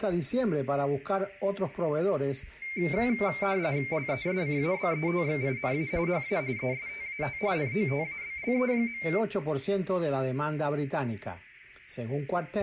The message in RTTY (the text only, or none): LESCABETXINA HA ESTAT NOTABLE.